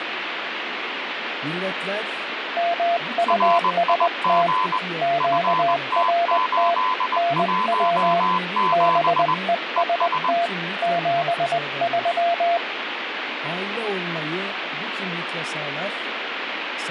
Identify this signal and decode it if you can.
Morse code, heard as two keyed tones, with radio static. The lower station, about 20 wpm, 690 Hz: MUST QRT NW BEST 73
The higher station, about 20 wpm, 1020 Hz: RIG FT817 ES